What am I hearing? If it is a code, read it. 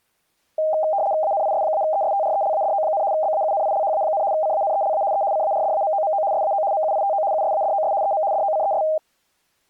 RTTY (75 baud, 170 Hz shift), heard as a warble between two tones, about 710 Hz centre. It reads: ANIS-ESTRELADO, BAUNILHA, CANELA E CARDAMOMO SAO MUITO USADOS EM DOCES